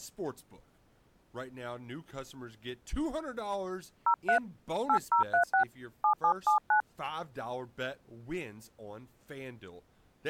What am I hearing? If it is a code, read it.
DTMF, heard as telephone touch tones, dialled by hand, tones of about 100 ms, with speech in English. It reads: 03 8036 7779